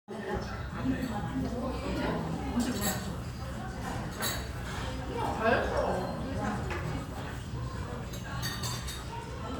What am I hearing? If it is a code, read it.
The noise of a restaurant. There is no code.